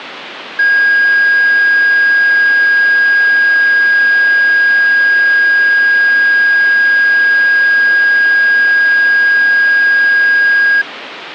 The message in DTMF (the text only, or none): none